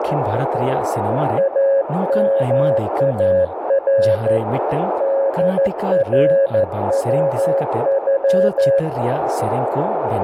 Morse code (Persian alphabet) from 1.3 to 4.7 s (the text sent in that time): امار